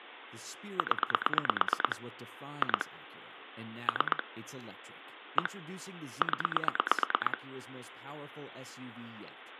Pulse dialling, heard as clicks on a phone line, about 9 pulses a second, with phone line noise and speech in English. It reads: 0 2 3 1 0